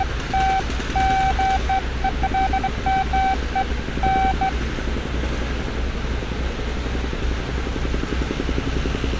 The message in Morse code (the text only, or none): none